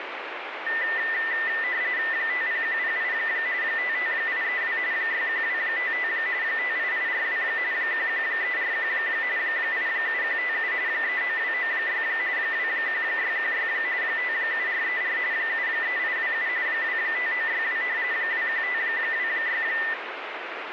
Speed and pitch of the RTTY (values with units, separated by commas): 45.45 baud, 170 Hz shift, 1900 Hz centre